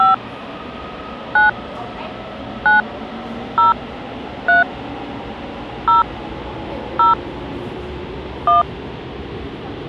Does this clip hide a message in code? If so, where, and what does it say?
Yes: DTMF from 0.0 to 8.6 s, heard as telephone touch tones, dialled by hand, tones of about 140 ms, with the noise of a subway station. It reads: 5 9 9 0 3 0 0 1